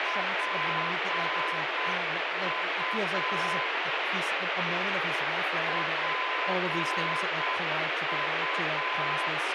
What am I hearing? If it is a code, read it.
Morse code, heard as a keyed tone, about 7 wpm, 1020 Hz, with heavy radio static and speech in English. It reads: PU PU